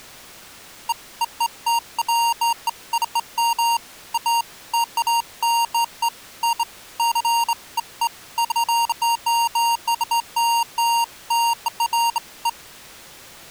Beeps of irregular length. There is no code.